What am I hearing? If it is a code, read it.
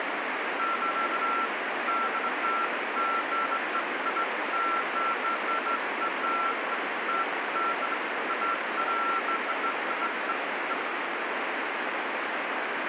Beeps of irregular length, with radio static. There is no code.